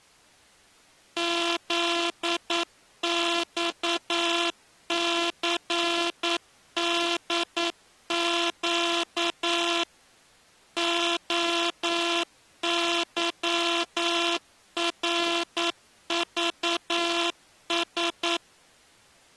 Morse code, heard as a buzzer, machine-sent, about 9 wpm. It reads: ZXCDQ OYRVS